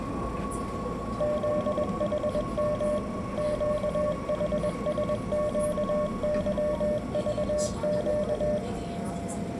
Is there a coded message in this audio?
Yes: Morse code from 1.1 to 8.6 s, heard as a keyed tone, machine-sent, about 21 wpm, 600 Hz, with room echo and the noise inside a subway train. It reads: ZHM QHSQYVQ